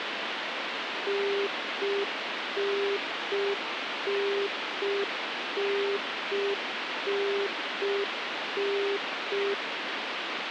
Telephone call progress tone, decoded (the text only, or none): congestion tone